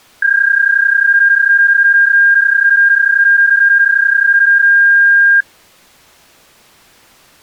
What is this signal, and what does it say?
PSK31 (31.25 baud), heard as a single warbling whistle, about 1600 Hz.